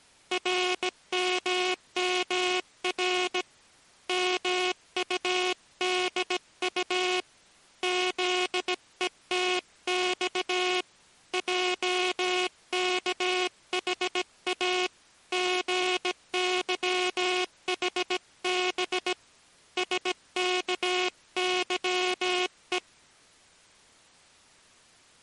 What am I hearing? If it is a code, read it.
Morse code, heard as a buzzer, hand-sent with a bug key, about 17 wpm. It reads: RMMR MUDU ZETX JKHA GYHB SKYE